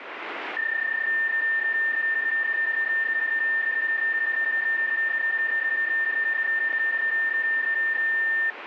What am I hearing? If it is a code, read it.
PSK31 (31.25 baud), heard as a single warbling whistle, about 1800 Hz, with radio static.